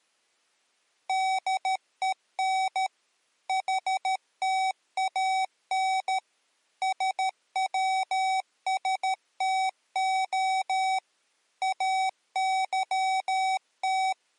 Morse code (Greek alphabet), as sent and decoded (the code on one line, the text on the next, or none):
-.. . -. / .... - .- -. / ... .-- ... - --- / …
ΔΕΝ ΗΤΑΝ ΣΩΣΤΟ …